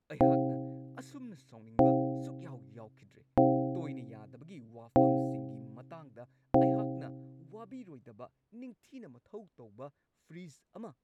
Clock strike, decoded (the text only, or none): 5